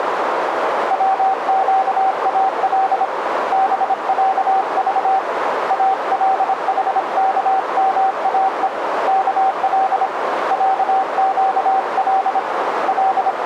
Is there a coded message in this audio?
Yes: Morse code (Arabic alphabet) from 0.8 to 13.5 s, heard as a keyed tone, hand-sent with a paddle, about 26 wpm, 770 Hz, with radio static and a narrow filter. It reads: وقال بعض الحكماء كل عقل …